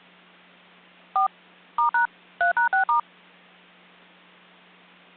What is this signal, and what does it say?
DTMF, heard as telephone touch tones, dialled by machine, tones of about 110 ms. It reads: 4 *# 3#6*